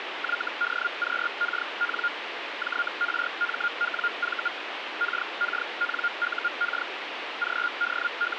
Hellschreiber (Feld-Hell, 122.5 baud), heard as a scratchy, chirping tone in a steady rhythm, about 1410 Hz, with radio static. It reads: YDQKN JRMWV KKNUK …